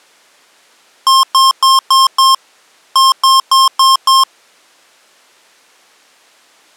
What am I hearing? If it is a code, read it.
Beep code, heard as beeps from a small speaker, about 1060 Hz. 5-5.